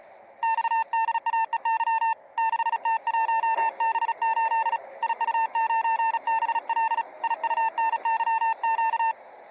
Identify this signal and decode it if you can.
Morse code, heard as a keyed tone, hand-sent with a paddle, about 36 wpm, 900 Hz, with the noise inside a bus. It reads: XDAEY 6T1B8 IU9BL IUNYQ